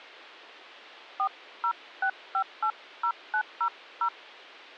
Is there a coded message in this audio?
Yes: DTMF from 1.2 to 4.1 s, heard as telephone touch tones, dialled by hand, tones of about 80 ms. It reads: 406580900